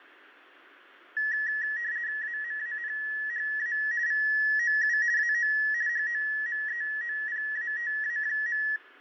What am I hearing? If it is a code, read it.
RTTY (50 baud, 170 Hz shift), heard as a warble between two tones, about 1800 Hz centre, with fading and room echo. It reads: AMANHA VOU AO HOMEOPATA.